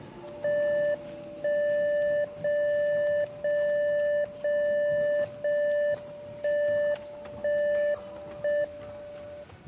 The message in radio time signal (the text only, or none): 1 0 0 0 0 1 1 1 M